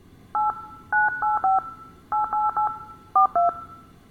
DTMF, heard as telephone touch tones, dialled by hand, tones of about 150 ms, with room echo. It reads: 8 985 888 42